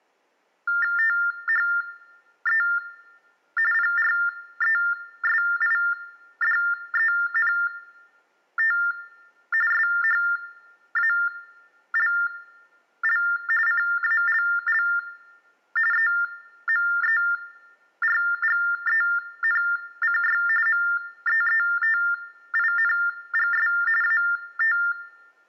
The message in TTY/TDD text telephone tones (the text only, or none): THE PRESIDENT SHALL CALL EMERGENCY MEETINGS AT